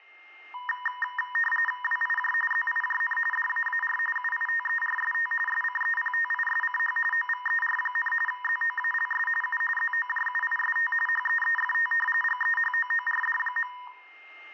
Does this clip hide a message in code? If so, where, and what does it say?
Yes: RTTY (45.45 baud, 850 Hz shift) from 0.5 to 13.9 s, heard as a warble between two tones, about 1420 Hz centre, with a steady whistle near 2110 Hz and room echo. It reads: WIJ ZIJN DAAR UITERST SCEPTISCH OVER, ZOALS U ZOJUIST HEEFT GEHOORD.